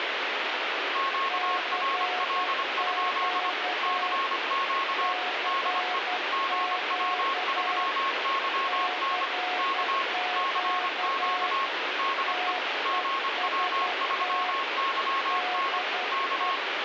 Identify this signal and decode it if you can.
Morse code, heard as two keyed tones, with radio static. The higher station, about 25 wpm, 1090 Hz: QRL? CQ DE GW3YN K CQ DE GW3YN K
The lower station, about 11 wpm, 730 Hz: CQ CQ CQ TEST DE